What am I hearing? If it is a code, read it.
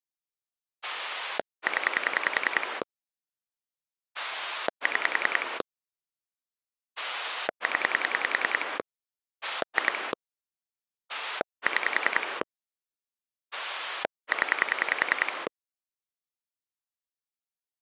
Pulse dialling, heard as a rotary dial, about 10 pulses a second. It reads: 0 6 0 2 6 0